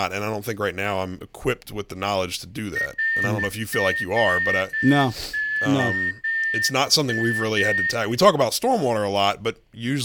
Morse code, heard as a whistle, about 11 wpm, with room echo and speech in English. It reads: ROOM